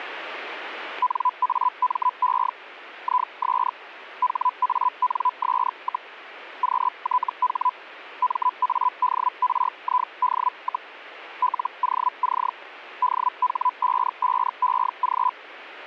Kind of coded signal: Hellschreiber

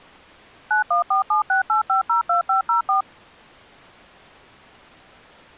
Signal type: DTMF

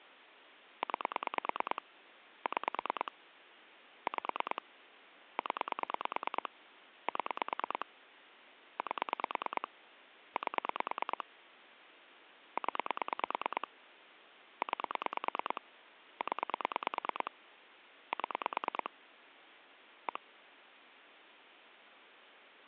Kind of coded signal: pulse dialling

